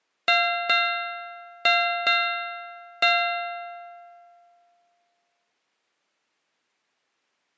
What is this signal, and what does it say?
Ship's bell, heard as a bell. 5. Five half-hours of the watch have passed.